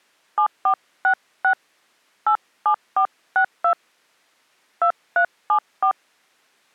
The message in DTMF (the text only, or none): 7466 87462 2374